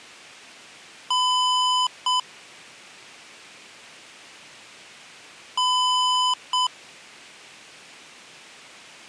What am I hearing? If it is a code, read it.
Beep code, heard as beeps from a small speaker, played twice, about 1000 Hz. 1 long, 1 short. In IBM BIOS tables: system board problem.